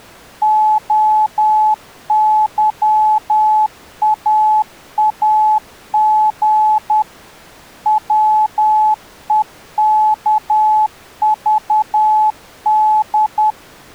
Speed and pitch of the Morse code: 10 wpm, 860 Hz

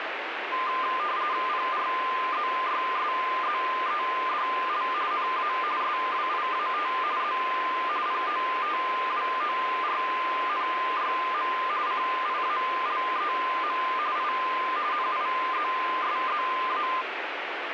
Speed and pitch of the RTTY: 45.45 baud, 170 Hz shift, 1120 Hz centre

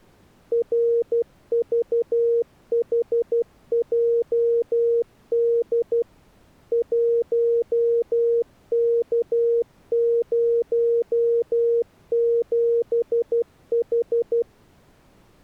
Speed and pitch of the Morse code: 12 wpm, 470 Hz

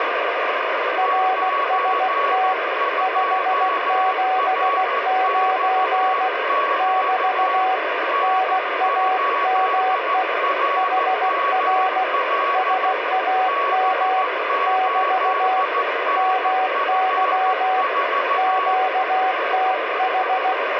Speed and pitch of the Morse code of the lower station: 16 wpm, 750 Hz

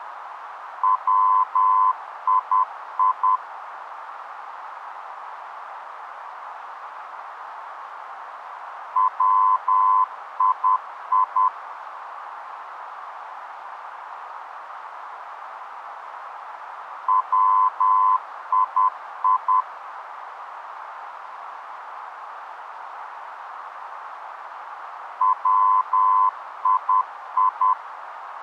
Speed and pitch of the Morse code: 10 wpm, 1020 Hz

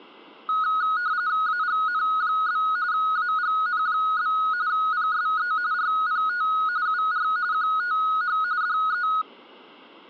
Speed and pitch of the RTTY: 45.45 baud, 170 Hz shift, 1360 Hz centre

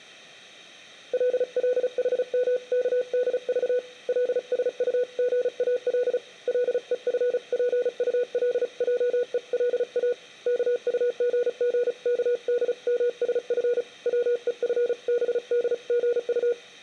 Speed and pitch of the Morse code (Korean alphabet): 35 wpm, 490 Hz

